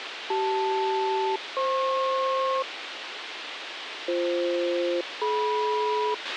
Aircraft SELCAL, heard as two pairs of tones, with radio hiss and a squelch burst at the end. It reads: CL-FP BF-DM